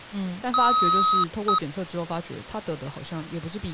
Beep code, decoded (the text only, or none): 1 long, 1 short